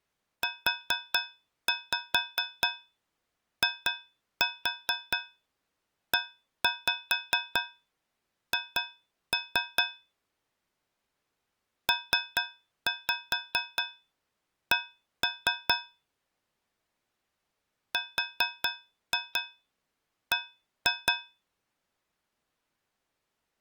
Tap code, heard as taps on a metal pipe, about 4 knocks a second. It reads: UIEH PC RB